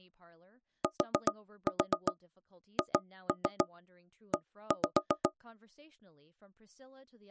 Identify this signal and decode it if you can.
Tap code, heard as knocks on wood, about 7 knocks a second, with speech in English. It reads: THE